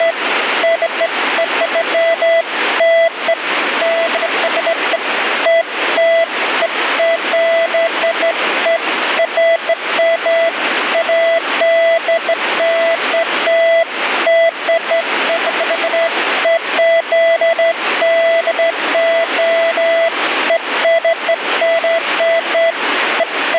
Beeps of irregular length, with radio static. There is no code.